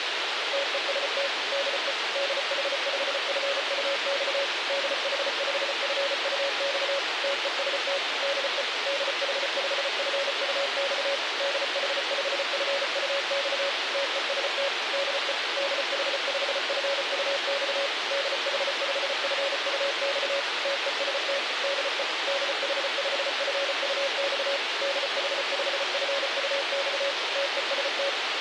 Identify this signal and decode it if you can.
Morse code, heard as a keyed tone, machine-sent, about 34 wpm, 560 Hz, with radio hiss. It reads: TEST DE DH5FUX DH5FUX TEST DE DH5FUX DH5FUX TEST DE DH5FUX DH5FUX TEST DE DH5FUX DH5FUX TEST